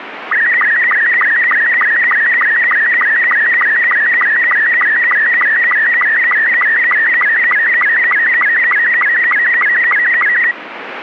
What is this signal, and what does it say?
SSTV (slow-scan television), Robot 72, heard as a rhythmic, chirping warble, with radio static.